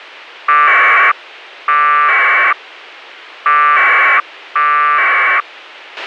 Packet radio (AX.25, as in APRS), 1200 baud, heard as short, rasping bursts, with a squelch burst at the end.